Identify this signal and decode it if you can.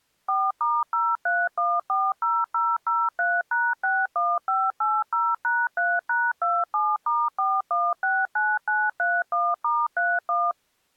DTMF, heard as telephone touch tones, dialled by machine, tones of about 220 ms. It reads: 4*03140003#61580#3#27*4169931*31